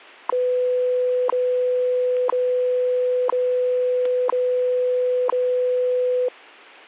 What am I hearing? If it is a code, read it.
Radio time signal (WWV, Colorado), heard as ticks, one a second.